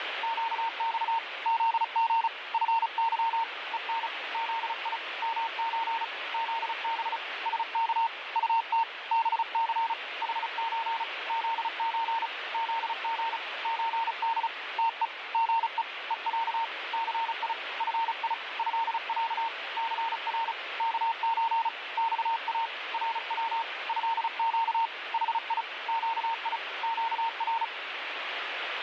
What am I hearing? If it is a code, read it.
Morse code (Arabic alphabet), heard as a keyed tone, hand-sent with a paddle, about 35 wpm, 910 Hz, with radio static. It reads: قص ذغ فظ ءن ذي مز ذب سك طت بث حز ذز ذغ زد تء غء ءع ثي في هع ثر كز صا رو هق حي قي قر